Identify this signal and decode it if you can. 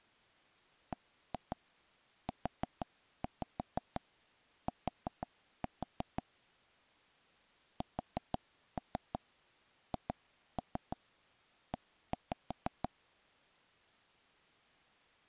Tap code, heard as taps on a table, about 6 knocks a second. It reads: BUT SHE